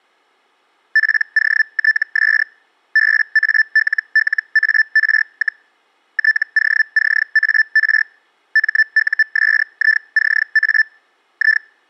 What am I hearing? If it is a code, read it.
Hellschreiber (Feld-Hell, 122.5 baud), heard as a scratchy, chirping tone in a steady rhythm, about 1750 Hz. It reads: POTS BALLAR, TOCAR MUSICA I